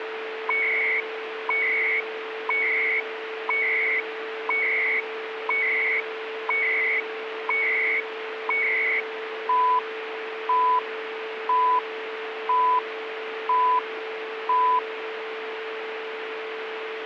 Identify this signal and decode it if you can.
Radio time signal (CHU, Canada), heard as beeps and data bursts, one a second, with radio static and a steady whistle near 440 Hz.